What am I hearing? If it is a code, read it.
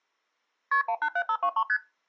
Multi-frequency trunk signalling (R1, as on North American trunks), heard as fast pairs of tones, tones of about 70 ms. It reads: KP 187523 ST